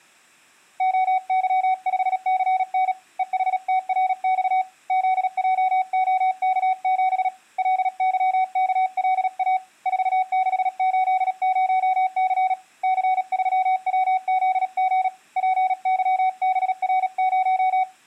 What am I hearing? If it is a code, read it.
Morse code, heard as a keyed tone, hand-sent with a paddle, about 37 wpm, 750 Hz. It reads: OY5CN EHTRX ZJOK7 LYKLA 4680C C3WZG PYBR0